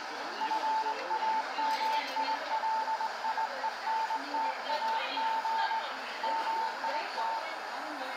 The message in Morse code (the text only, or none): FAMILIENTAG MIT